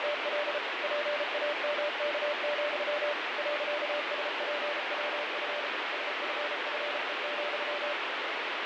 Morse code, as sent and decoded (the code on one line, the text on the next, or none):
… / .--. .- -- -.- --..-- / .-.-.- ... .--. .-- ..-. / ... ..-. ..-. . --..--
… PAMK, .SPWF SFFE,